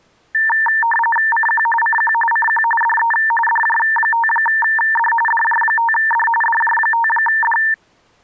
RTTY (45.45 baud, 850 Hz shift), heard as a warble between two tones, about 1350 Hz centre. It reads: CQ CQ CQ DE DJ5D DJ5D DJ5D